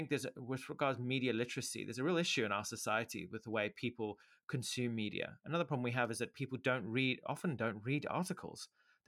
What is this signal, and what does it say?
Speech in English. There is no code.